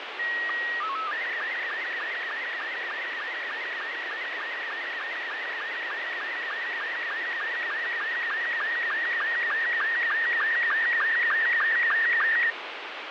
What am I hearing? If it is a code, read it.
SSTV (slow-scan television), Robot 72, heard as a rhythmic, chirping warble, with heavy radio static and fading.